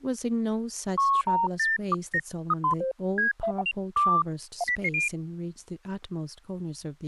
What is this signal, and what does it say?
Electronic bleeps of random pitch and length, with speech in English. There is no code.